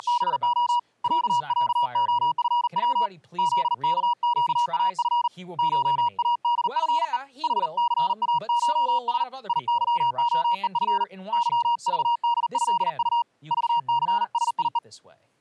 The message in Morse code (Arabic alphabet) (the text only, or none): … ععخفو ذكقاف شادفء حثاشس يظخءف ظضدهط ضثسيء